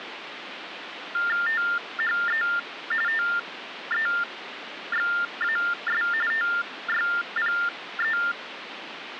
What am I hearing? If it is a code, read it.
TTY/TDD text telephone tones (45.45 baud Baudot), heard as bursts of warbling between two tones, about 400 Hz shift, 1600 Hz centre, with phone line noise. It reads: THE TEXAS TYPE